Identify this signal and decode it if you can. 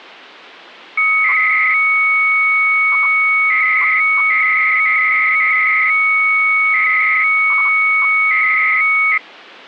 300-baud modem data (Bell 103 tones), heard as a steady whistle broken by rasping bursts, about 300 baud, 200 Hz shift.